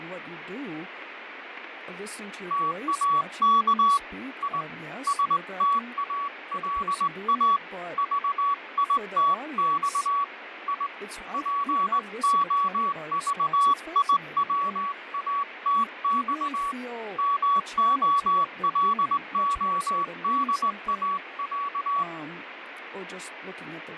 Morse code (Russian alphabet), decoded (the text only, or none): ТАК И СТАЛА ЖИТЬ И ПОЖИВАТЬ МОЛОДАЯ